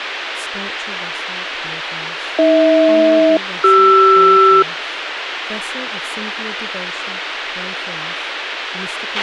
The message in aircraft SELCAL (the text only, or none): AH-CR